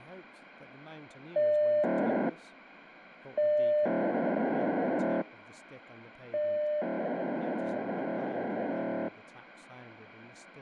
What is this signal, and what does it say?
POCSAG pager data (1200 baud), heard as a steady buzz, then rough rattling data, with radio hiss and speech in English.